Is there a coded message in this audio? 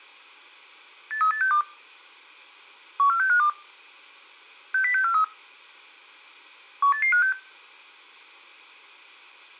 Yes: five-tone selective call (CCIR) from 1.1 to 7.3 s, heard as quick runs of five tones, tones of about 100 ms, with room echo. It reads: 83862 14652 60643 18856